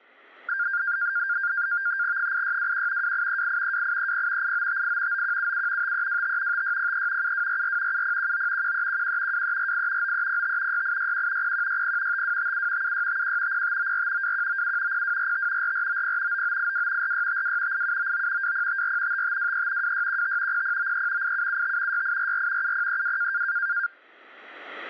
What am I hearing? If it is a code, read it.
NAVTEX (SITOR-B), 100 baud, 170 Hz shift, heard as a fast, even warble, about 1500 Hz centre. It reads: 8621 2838 2830 8958 9177 5325 5603 7244 7019 1311 2348 9305 6861 0160 5257 7651 0594 2197 0245 4490 9982 4652 8799 2054 5523 2615 0093 8775 6844 7032